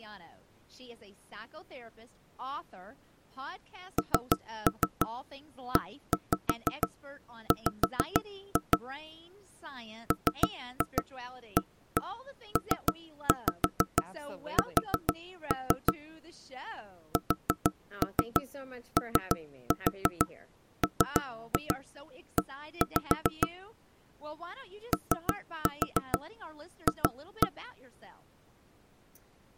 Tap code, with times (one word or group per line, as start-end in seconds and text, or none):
4.0-8.8 NEW
10.1-15.9 MAPS
17.2-23.5 SOME
24.9-27.5 OF